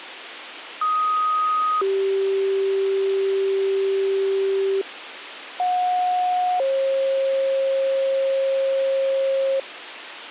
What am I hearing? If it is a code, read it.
Two-tone page, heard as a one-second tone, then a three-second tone, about 1250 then 390 Hz, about 730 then 540 Hz, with radio hiss.